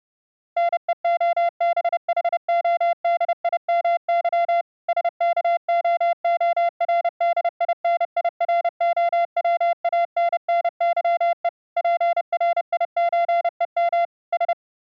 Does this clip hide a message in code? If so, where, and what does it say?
Yes: Morse code (Russian alphabet) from 0.5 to 14.6 s, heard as a keyed tone, machine-sent, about 30 wpm, 690 Hz. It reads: НЕОБХОДИМЫ СКООРДИНИРОВАННЫЕ ПРИЧЕМ С